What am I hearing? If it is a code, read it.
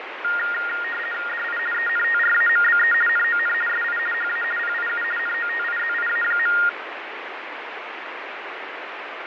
RTTY (50 baud, 450 Hz shift), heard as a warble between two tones, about 1650 Hz centre, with radio static and fading. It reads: DI ENTRAMBE NON SI HA PIU NOTIZIA.